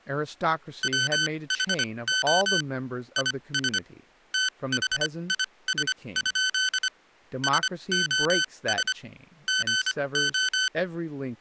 Morse code, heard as electronic beeps, machine-sent, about 25 wpm, spaced as for 20 wpm, 1500 Hz, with speech in English. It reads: WHO IS THIS? SOS GO